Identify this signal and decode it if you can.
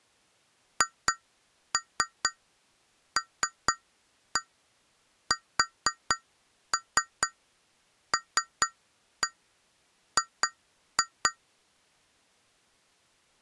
Tap code, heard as taps on glass, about 4 knocks a second. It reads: HLSLG